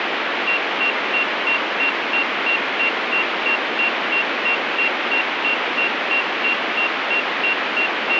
Evenly repeated beeps, with radio static. There is no code.